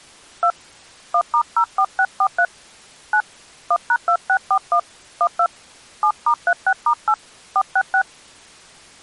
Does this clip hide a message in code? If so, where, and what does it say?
Yes: DTMF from 0.4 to 8.0 s, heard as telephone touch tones, dialled by hand, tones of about 70 ms. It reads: 2 1*04643 9 1#2641 12 7*36*8 466